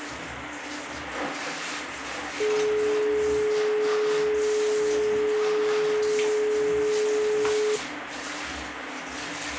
Telephone call progress tone (425 Hz plan, as in most of Europe), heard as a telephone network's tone, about 420 Hz, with phone line noise and the noise of a restroom. Dial tone.